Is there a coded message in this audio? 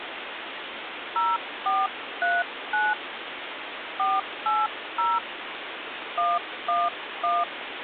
Yes: DTMF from 1.2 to 7.4 s, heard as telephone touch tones, dialled by hand, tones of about 210 ms, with phone line noise. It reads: 0439 480 111